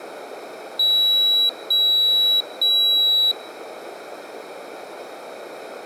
Beep code, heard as a piezo beeper, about 3900 Hz. 3 long. In IBM BIOS tables: keyboard card error.